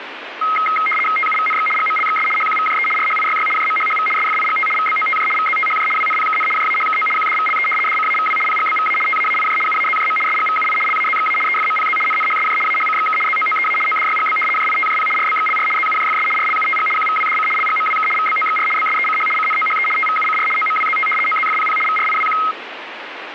RTTY (75 baud, 850 Hz shift), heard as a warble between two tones, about 1700 Hz centre, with radio static. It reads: TUVNX GMLXS HQVJE RHIYY JMHHV SFIGT VBOTJ VZTHJ WNPKN JAHKO QDVLE DCAVW PGBVA TAAIJ UAZJM SGVUI LAZXA EFMPZ NNHSJ AHCXK ZOOEA ODYGB JITJP RBXLR ZUJFS RLUTG QVWDC LGMWK VBOXR BSECH CNOHE TVUCR OMWZT OZFPP VRIWQ